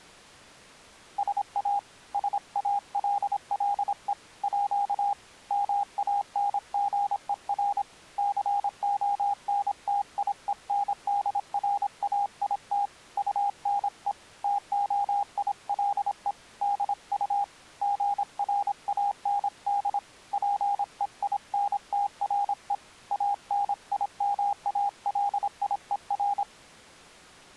Morse code (with French letters), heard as a keyed tone, hand-sent with a paddle, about 26 wpm, 810 Hz. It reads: SA SALLE À MANGER CONTIENDRAIT UNE TOILE DU GRAND PEINTRE ANIMALIER